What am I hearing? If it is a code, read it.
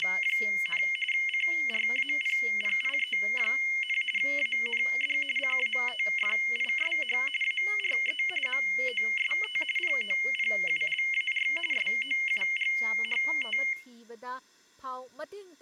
RTTY (45.45 baud, 850 Hz shift), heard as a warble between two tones, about 2550 Hz centre, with speech in Manipuri. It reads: … CRAPPIE, AND CATFISH ARE MOST POPULAR SOUGHT